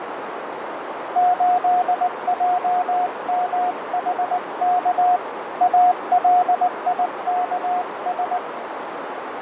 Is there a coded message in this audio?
Yes: Morse code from 1.1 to 8.4 s, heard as a keyed tone, hand-sent with a paddle, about 19 wpm, 720 Hz, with radio static, fading and a narrow filter. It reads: 8JMHK ALIKS